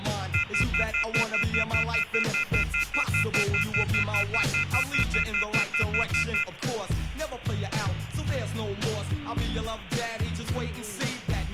Telephone call progress tone (North American plan), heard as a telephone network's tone, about 1400, 2050, 2450, 2600 Hz, 0.1 s on and 0.1 s off, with phone line noise. Off-hook warning tone.